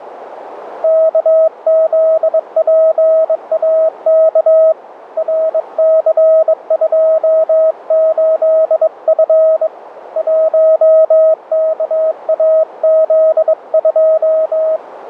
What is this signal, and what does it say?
Morse code, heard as a keyed tone, hand-sent with a bug key, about 22 wpm, 640 Hz, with radio static and a narrow filter. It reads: KZPAK RC28F 1KAZ2